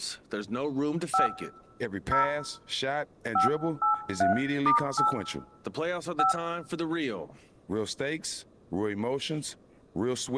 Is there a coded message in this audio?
Yes: DTMF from 1.1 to 6.3 s, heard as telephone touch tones, dialled by hand, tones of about 130 ms, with room echo and speech in English. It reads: 5 0 583*8 5